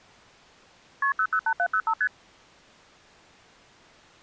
Multi-frequency trunk signalling (R1, as on North American trunks), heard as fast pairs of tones, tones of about 70 ms. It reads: KP 008705 ST